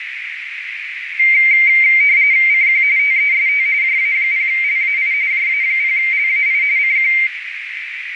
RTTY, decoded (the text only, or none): CQ TEST JA0LAI JA0LAI CQ